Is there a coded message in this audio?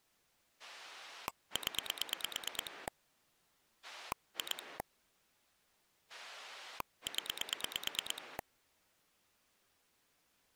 Yes: pulse dialling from 0.6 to 8.4 s, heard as a rotary dial, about 9 pulses a second. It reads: 0 2 0